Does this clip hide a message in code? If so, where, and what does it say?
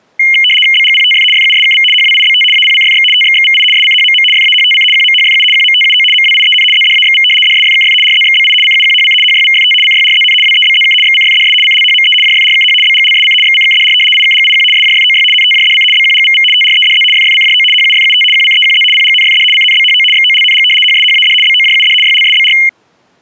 Yes: RTTY (75 baud, 850 Hz shift) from 0.2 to 22.7 s, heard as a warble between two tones, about 2550 Hz centre. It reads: BGPTF FUSKV HWIBT APCFX TXXVI SCHMM FAHTC QMHFU QMTUO MWIEN ZDAXV DSFKF RZXBI CUQHC HYVFT CYRZN WEBZK XCFDS CLHME JFRKH BGLSC XCKDR IKGIQ SJFOY NTJDC BQGVV TREDZ FFCJO HUFUT QCEQZ PGNFD CNBHO XOLNG HSHAD BOJUD YLSBR